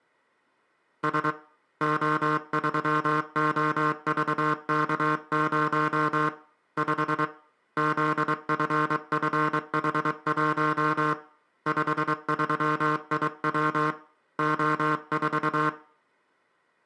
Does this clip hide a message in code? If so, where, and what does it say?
Yes: Morse code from 1.0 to 15.8 s, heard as a buzzer, hand-sent with a paddle, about 23 wpm, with room echo. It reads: S O3OVK0 5 ZFFH1 53IW O4